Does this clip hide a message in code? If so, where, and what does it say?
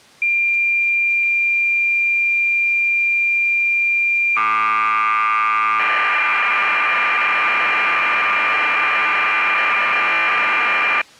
Yes: cassette data (Kansas City type), 1200 baud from 0.2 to 11.0 s, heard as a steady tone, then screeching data.